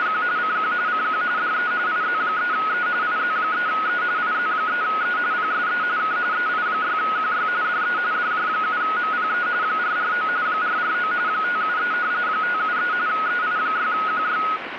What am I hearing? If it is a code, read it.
RTTY (45.45 baud, 170 Hz shift), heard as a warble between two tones, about 1360 Hz centre, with radio static. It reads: … CQ CQ DE IZ3E IZ3E IZ3E PSE K EI6QY DE DJ7MPE 449 449 573 573 EI6QY